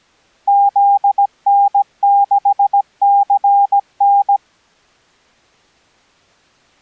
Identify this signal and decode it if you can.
Morse code, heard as a keyed tone, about 17 wpm, 800 Hz. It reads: ZN6CN